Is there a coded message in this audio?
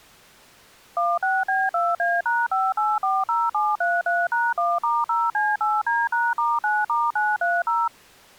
Yes: DTMF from 1.0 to 7.9 s, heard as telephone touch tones, dialled by machine, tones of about 210 ms. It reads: 16B2A#5840733#1*0C8D#*9*930